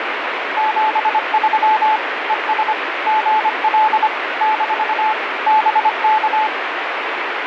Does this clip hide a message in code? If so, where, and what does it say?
Yes: Morse code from 0.5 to 6.5 s, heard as a keyed tone, machine-sent, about 25 wpm, 870 Hz, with radio static. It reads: 73 ES GL - BK